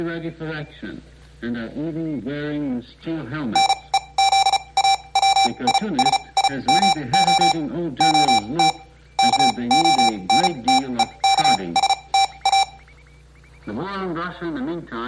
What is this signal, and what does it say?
Morse code (Russian alphabet), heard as electronic beeps, machine-sent, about 35 wpm, spaced as for 25 wpm, 780 Hz, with room echo. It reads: НЕЗАВИСИМО ОТ КОНТЕКСТА